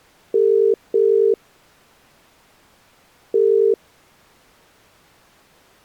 Telephone call progress tone (as in the UK, Ireland, Australia and similar networks), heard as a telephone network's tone, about 400, 450 Hz. Ringback tone.